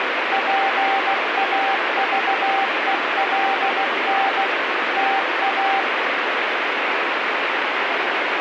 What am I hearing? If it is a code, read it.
Morse code, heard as a keyed tone, machine-sent, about 16 wpm, 780 Hz, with heavy radio static. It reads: PAVELN TA